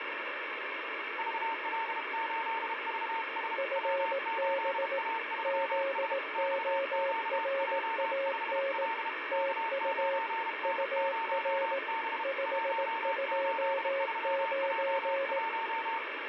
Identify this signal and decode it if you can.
Morse code, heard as two keyed tones, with radio static. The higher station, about 32 wpm, 910 Hz: VL8VS W8A3S XQJ5L K9N0B 183J1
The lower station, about 18 wpm, 550 Hz: FB ZORAN TU UR 529